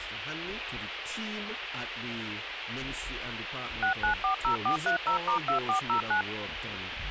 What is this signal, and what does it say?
DTMF, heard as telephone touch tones, dialled by machine, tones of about 110 ms, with radio hiss. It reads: 6940430*2409